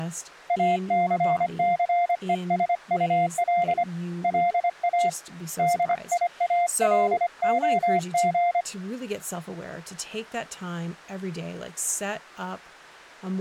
Morse code, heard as a keyed tone, hand-sent with a paddle, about 25 wpm, 700 Hz, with speech in English. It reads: ACCESUL LA DIALOG